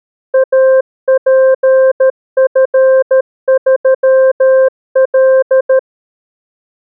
Morse code, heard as a keyed tone, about 13 wpm, 530 Hz. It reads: APF3L